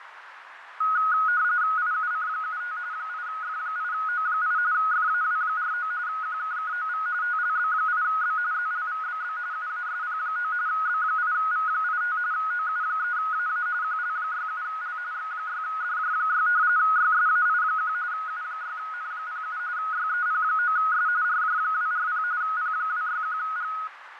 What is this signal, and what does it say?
RTTY (45.45 baud, 170 Hz shift), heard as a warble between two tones, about 1360 Hz centre, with radio static, fading and a narrow filter. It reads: IUC75 8F8O8 FAW49 QKKOV TLB8B ZLVBB UASP9 B8V85 OU3AA QL67L X6DJ6 YSAI1 U6N07 YEP9S RJ240 P261G